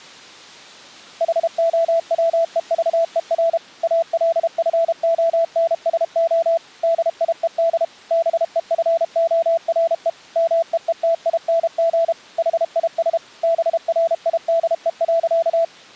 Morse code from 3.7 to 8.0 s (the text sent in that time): ALFONSO DIED